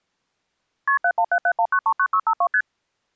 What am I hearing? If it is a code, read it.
Multi-frequency trunk signalling (R1, as on North American trunks), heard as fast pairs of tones, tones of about 70 ms. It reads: KP 71771939652 ST